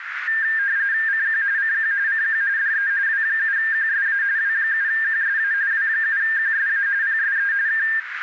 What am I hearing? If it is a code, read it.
RTTY (45.45 baud, 170 Hz shift), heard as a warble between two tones, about 1700 Hz centre, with radio static and a narrow filter. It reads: CQ CQ CQ DE W7QSA W7QSA W7QSA PSE K